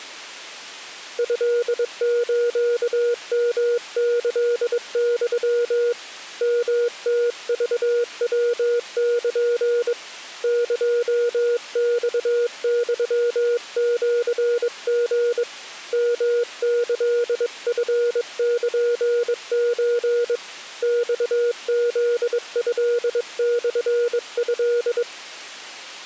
Morse code (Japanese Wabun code), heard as a keyed tone, hand-sent with a bug key, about 22 wpm, 480 Hz. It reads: トスヨキユ ヨムクヤル エマユシリ ヨキチルソ マフトモト